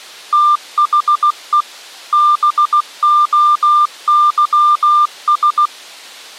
Morse code, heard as a keyed tone, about 16 wpm, 1200 Hz. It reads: THE BOYS